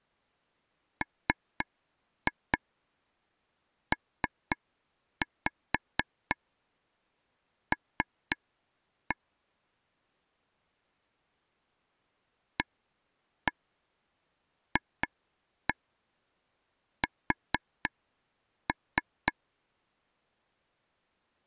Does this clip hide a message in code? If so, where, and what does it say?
Yes: tap code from 1.0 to 19.3 s, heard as taps on a table, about 4 knocks a second. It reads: MPL AFS